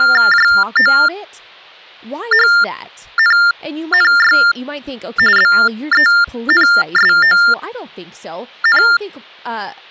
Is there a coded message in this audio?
Yes: TTY/TDD text telephone tones (45.45 baud Baudot) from 0.0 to 9.0 s, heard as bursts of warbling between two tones, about 400 Hz shift, 1600 Hz centre, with speech in English. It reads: JOHNNY BENSON